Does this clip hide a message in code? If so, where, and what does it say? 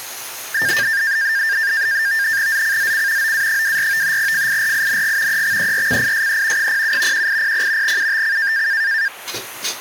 Yes: NAVTEX (SITOR-B), 100 baud, 170 Hz shift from 0.5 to 9.1 s, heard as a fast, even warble, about 1700 Hz centre, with kitchen noise. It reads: ZCZC OA24 FIRING EXERCISE 07 1800 UTC